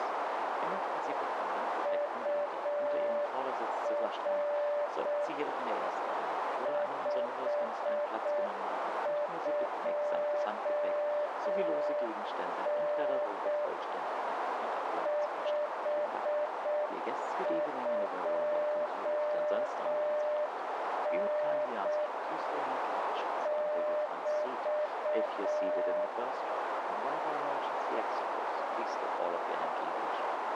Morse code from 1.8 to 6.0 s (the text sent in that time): UR